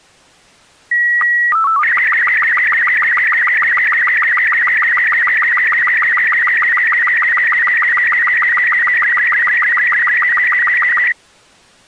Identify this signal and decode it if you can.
SSTV (slow-scan television), Robot 36, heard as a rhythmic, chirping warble.